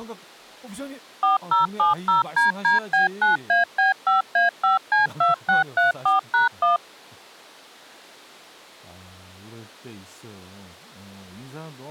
DTMF, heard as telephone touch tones, dialled by machine, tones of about 140 ms, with speech in Korean. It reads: 4070DDB9AB5A5C2634#1